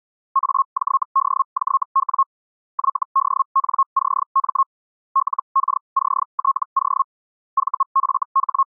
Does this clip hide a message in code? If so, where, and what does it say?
Yes: Hellschreiber (Feld-Hell, 122.5 baud) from 0.3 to 8.8 s, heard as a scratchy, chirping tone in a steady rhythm, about 1080 Hz. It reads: AJDJW YDNCM LKCTO …